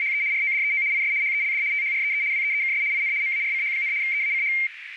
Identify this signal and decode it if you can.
RTTY (75 baud, 170 Hz shift), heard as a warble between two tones, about 2200 Hz centre, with radio static and a narrow filter. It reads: … RODEO IS HELD THREE WEEKS IN MARCH, EACH